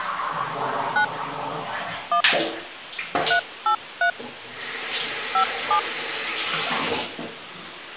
DTMF, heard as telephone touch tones, dialled by hand, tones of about 90 ms, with the noise of a restroom. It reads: 9 1 383 57